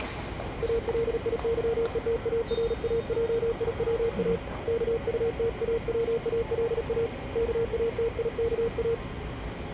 Morse code, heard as a keyed tone, hand-sent with a paddle, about 37 wpm, 460 Hz, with the noise of a subway station. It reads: ALIYETARAJIWA KUTAWALA KATIKA